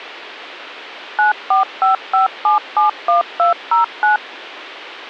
DTMF, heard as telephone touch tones, dialled by machine, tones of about 130 ms. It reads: 9455771209